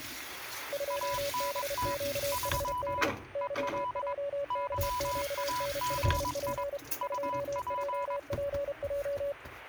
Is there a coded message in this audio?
Yes: Morse code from 0.7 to 9.4 s, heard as two keyed tones, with kitchen noise. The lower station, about 32 wpm, 570 Hz: 2BQHD YJKQN5P 2JPJ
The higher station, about 22 wpm, 990 Hz: ANT 3 EL YAGI UP